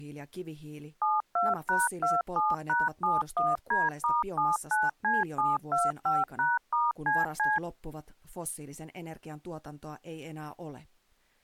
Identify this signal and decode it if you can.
DTMF, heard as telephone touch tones, dialled by machine, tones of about 190 ms, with speech in Finnish. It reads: 72#27#71D*79C725#*CC